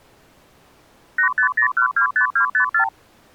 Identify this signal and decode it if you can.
Multi-frequency trunk signalling (R2, with the far end's replies), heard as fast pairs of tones, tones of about 100 ms. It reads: 850125254